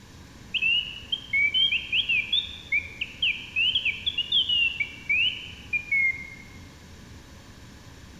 Bird-like chirps, with room echo. There is no code.